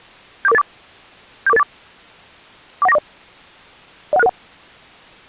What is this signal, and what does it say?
Five-tone selective call (EIA), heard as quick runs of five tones, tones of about 30 ms. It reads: 74484 74484 41940 01661